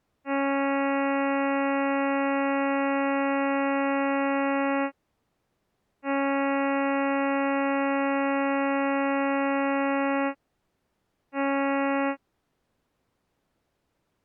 Ship horn signal, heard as a ship's horn, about 280 Hz. 2 long, 1 short. At sea: I intend to overtake on your starboard side.